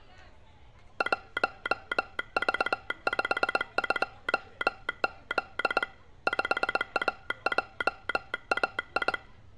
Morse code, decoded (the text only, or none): 1V52Z 5AJAI